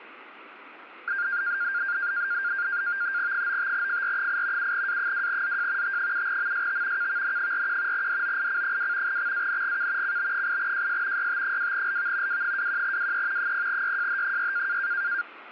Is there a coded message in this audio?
Yes: NAVTEX (SITOR-B), 100 baud, 170 Hz shift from 1.1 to 15.2 s, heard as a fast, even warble, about 1500 Hz centre, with radio static. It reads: 95FR8 7A2ZJ T7MST KVN41 DOIC2 XANGK CB8JS YT2LV W21WE 0YJH6